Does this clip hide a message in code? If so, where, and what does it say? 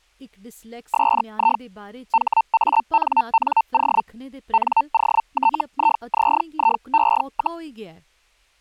Yes: Hellschreiber (Feld-Hell, 122.5 baud) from 0.9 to 7.6 s, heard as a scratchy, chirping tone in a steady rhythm, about 900 Hz, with speech in Dogri. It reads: SI HANNO NOTIZIE,